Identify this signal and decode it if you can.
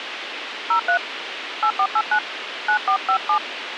DTMF, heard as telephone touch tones, dialled by hand, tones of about 80 ms, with radio hiss. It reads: 03 8489 9457